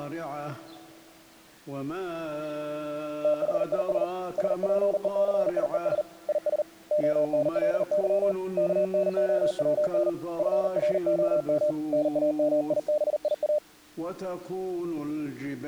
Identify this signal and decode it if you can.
Morse code, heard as a keyed tone, hand-sent with a paddle, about 39 wpm, 600 Hz. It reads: THIS SPECIES IS ONLY KNOWN FROM NAMIBIA